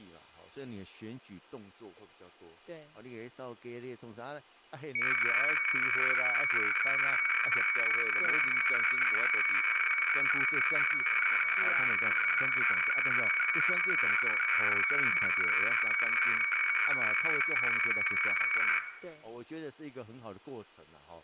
Weather fax (radiofax), 120 lines a minute, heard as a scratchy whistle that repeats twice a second, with room echo and speech in Chinese.